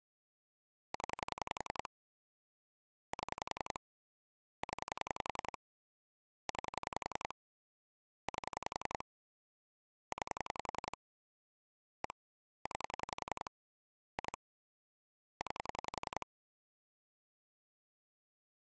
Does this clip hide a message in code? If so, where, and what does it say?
Yes: pulse dialling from 0.9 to 16.2 s, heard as clicks on a phone line, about 11 pulses a second. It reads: 0 7 0 9 8 9 1 9 2 9